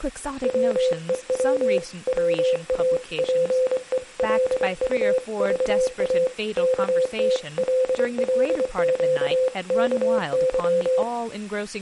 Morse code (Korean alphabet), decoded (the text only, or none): 밥 보자기로 어깨에